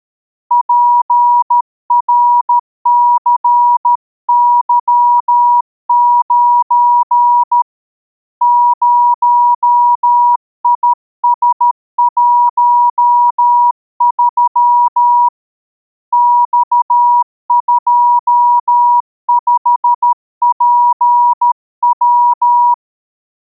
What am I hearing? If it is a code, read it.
Morse code, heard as a keyed tone, hand-sent with a paddle, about 13 wpm, 960 Hz. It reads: PRCY9 0IS13 X25PW